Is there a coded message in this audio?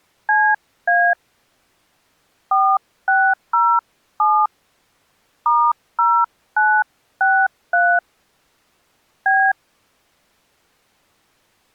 Yes: DTMF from 0.3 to 9.5 s, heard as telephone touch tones, dialled by hand, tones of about 260 ms. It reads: CA 4607 *0963 B